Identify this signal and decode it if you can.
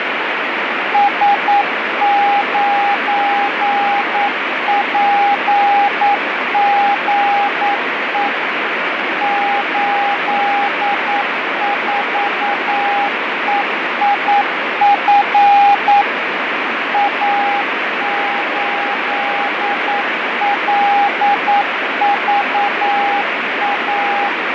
Morse code, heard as a keyed tone, machine-sent, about 9 wpm, 810 Hz, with heavy radio static and fading. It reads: S9PGE 84EIF A8LVA